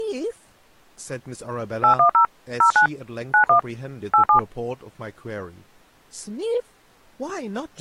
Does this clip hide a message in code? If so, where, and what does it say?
Yes: DTMF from 1.8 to 4.4 s, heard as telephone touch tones, dialled by machine, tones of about 100 ms, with speech in English. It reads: 810 09 91 87